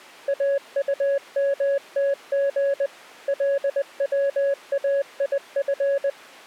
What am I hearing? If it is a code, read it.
Morse code, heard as a keyed tone, machine-sent, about 20 wpm, 560 Hz. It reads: AUMTG LWAIF